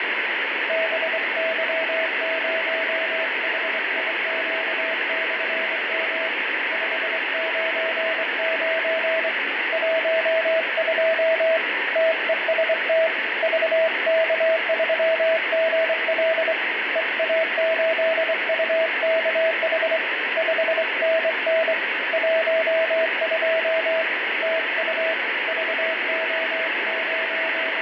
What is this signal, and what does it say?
Morse code, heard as a keyed tone, hand-sent with a straight key, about 24 wpm, 650 Hz, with heavy radio static and fading. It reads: BY0HIQ/M 599 12 TEST VK3GL EA8UKH 5NN 12 TU …